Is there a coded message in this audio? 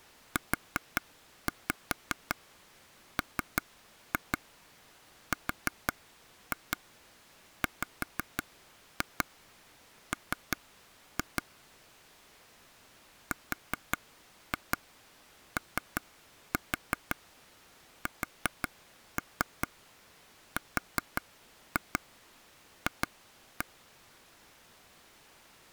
Yes: tap code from 0.4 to 23.6 s, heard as taps on a table, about 5 knocks a second. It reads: UMRWM ROSRF